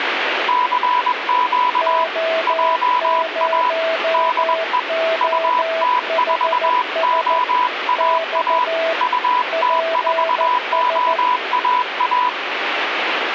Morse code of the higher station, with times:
0.5-2.0 CQ
2.5-3.7 JA
4.1-4.8 DE
5.2-8.6 UT4OAA
9.0-12.3 UT4OAA

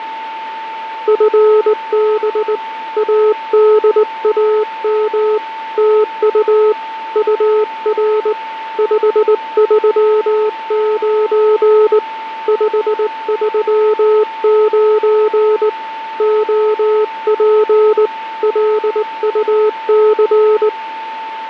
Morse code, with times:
1.1-2.6 FB
3.0-5.4 ADAM
5.8-6.7 TU
7.2-8.3 UR
8.8-12.0 539
12.5-15.7 539
16.2-18.1 OP
18.4-20.7 LUC

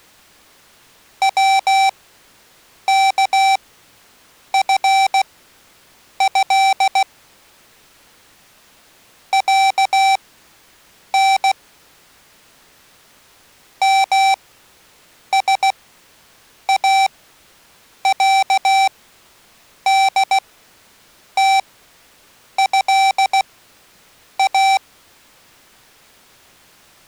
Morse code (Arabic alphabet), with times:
1.2-7.0 وكفه
9.3-11.5 عن
13.8-24.8 مساعدتها

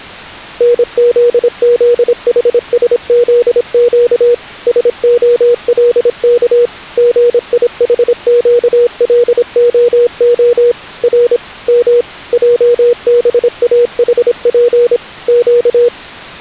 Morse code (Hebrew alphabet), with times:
0.6-4.3 נזזחשזק
4.7-6.7 שהלך
7.0-10.7 גיחקלהה
11.0-11.4 ר
11.7-12.0 מ
12.3-15.0 עבאחף
15.3-15.9 ק

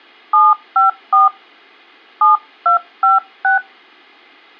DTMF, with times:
0.3-1.3 754
2.2-3.6 7256

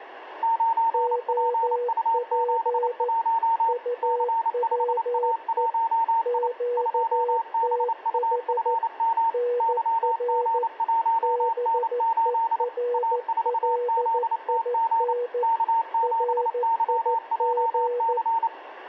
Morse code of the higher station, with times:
0.4-3.7 9PU71
4.0-6.5 C5A1I
6.8-9.3 2BUFM
9.6-12.6 YG1N8
12.9-15.1 A4ZTG
15.4-18.5 K7YJC

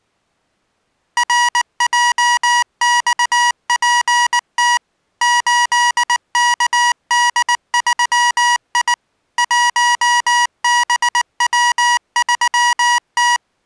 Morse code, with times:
1.2-4.8 RJXPT
5.2-8.9 8KD3I
9.4-13.4 1BW3T

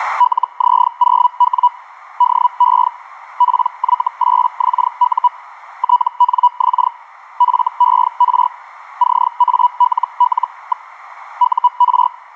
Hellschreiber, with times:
0.2-1.7 LZ0W
2.2-2.9 DE
3.4-5.3 PY8XU
5.8-6.9 TNX
7.4-8.5 FER
9.0-10.9 CALL.
11.4-12.1 UR

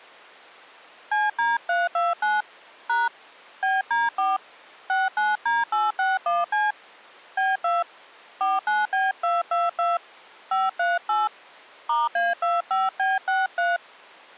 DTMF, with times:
1.1-2.4 CD329
2.9-3.1 #
3.6-4.4 BD4
4.9-6.7 69D861C
7.4-7.8 B2
8.4-10.0 49B222
10.5-11.3 538
11.9-13.8 *A25B63

